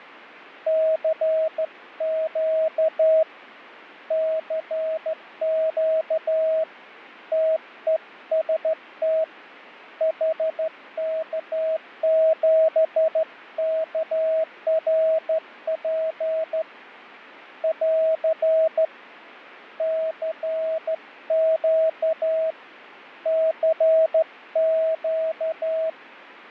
Morse code, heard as a keyed tone, hand-sent with a straight key, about 13 wpm, 640 Hz, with fading. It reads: CQ CQ TEST HK7KRP <AR> CQ CQ